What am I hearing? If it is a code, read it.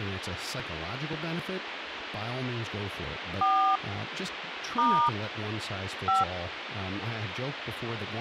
DTMF, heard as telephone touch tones, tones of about 240 ms, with phone line noise and speech in English. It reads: 4 * 5